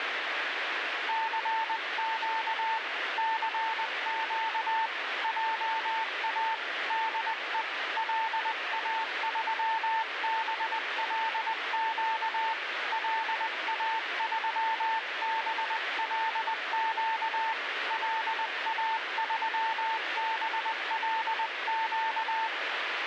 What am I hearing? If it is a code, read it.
Morse code, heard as a keyed tone, hand-sent with a paddle, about 20 wpm, 890 Hz, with radio static. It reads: CQ CQ JA DE LA3BLQ LA3BLQ LA3BLQ